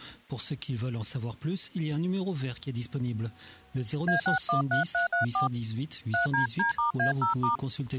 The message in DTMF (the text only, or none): A613334 3DD*A0*